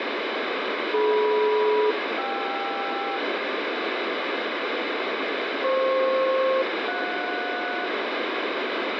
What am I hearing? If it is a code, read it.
Aircraft SELCAL, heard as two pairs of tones, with heavy radio static. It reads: DM-KR FP-JS